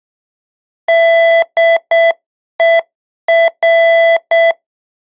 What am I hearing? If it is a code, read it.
Morse code, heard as electronic beeps, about 7 wpm, 670 Hz. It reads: DER